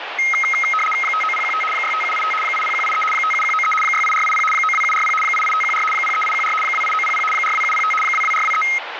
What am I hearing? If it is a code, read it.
RTTY (75 baud, 850 Hz shift), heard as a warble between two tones, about 1700 Hz centre, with radio static. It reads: 59015 65785 80183 57193 68480 92740 88514 03814 28900 42705 22423